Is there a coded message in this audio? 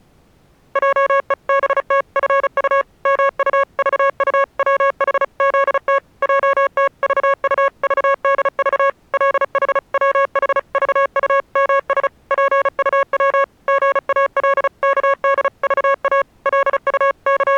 Yes: Morse code (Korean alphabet) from 0.7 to 17.6 s, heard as electronic beeps, machine-sent, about 35 wpm, 550 Hz. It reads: 하더니 미리부터 허리를 구부리며 집 속으로 …